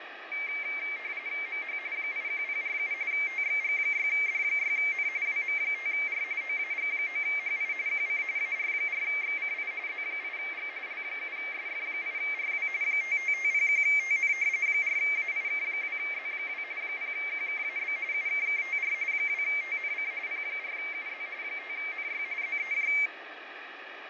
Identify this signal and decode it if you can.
RTTY (45.45 baud, 170 Hz shift), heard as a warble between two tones, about 2200 Hz centre, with radio static and fading. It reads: MH 81047 TXG6D6N WM5R OAG9HI QC AR4XCI Z8G L7SF8RW 55501TN 4AIK2Z2 0QKAB UKKTR 2TNC P4UZ 5NY ZEJ